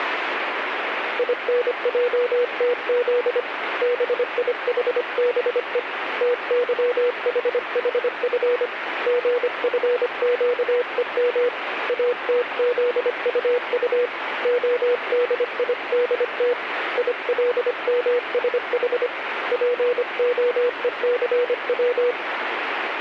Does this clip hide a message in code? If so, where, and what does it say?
Yes: Morse code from 1.1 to 22.2 s, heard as a keyed tone, hand-sent with a paddle, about 25 wpm, 490 Hz, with radio static. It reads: INJTZ BIHBE TYHHF GFQEM ATZUU ODIDT ILMSH POECW